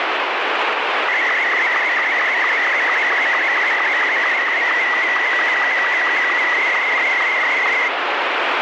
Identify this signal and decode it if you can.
SSTV (slow-scan television), Martin M2, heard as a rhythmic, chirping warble, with heavy radio static.